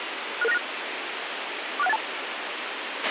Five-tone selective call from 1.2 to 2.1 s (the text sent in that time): 46182